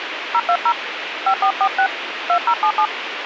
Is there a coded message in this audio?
Yes: DTMF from 0.3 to 2.9 s, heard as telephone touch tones, dialled by hand, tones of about 70 ms, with radio hiss. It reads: 020 5446 2077